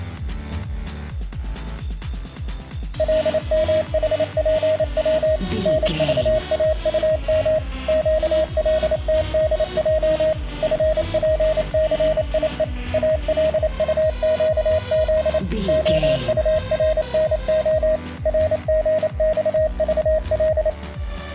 Morse code, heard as a keyed tone, machine-sent, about 28 wpm, 630 Hz. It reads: LMHPW NVAUM QLTDJ FPCIE ALUQZ OURNO RGXVL